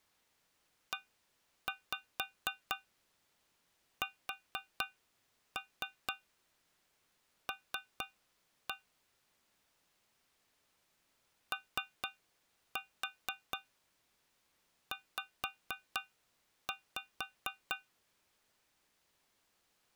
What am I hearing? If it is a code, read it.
Tap code, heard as taps on a metal pipe, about 4 knocks a second. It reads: ESL OZ